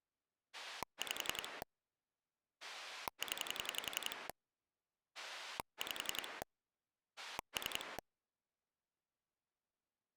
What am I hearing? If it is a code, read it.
Pulse dialling, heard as a rotary dial, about 11 pulses a second. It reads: 5 0 5 3